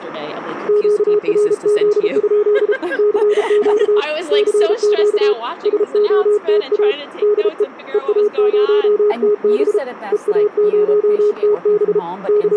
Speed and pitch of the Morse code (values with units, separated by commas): 33 wpm, 420 Hz